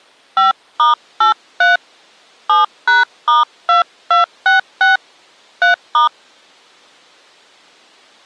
DTMF, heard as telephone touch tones, dialled by hand, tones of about 140 ms. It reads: 5*83 7#*2266 3*